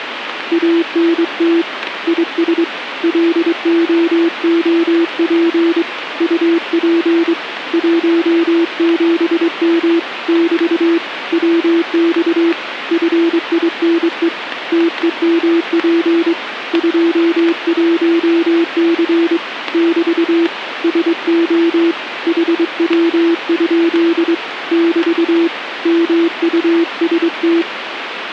Morse code, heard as a keyed tone, hand-sent with a straight key, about 23 wpm, 340 Hz, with radio static. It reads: ANT IS LOOP UP 17M <BT> WX FINE TEMP 21C <BT> SO HW? <BT> MUST